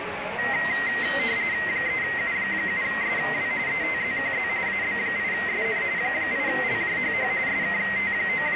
RTTY (45.45 baud, 170 Hz shift), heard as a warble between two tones, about 2000 Hz centre, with radio static and the noise of a cafe. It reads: 3U7SW ETZQZ AB8SN 8LJHH …